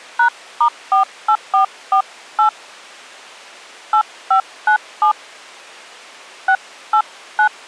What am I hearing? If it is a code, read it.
DTMF, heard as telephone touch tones, dialled by hand, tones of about 90 ms. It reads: #*48448 8597 689